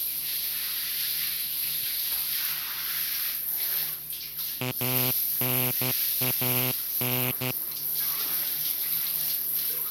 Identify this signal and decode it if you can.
Morse code (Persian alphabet), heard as a buzzer, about 12 wpm, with the noise of a restroom. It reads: انان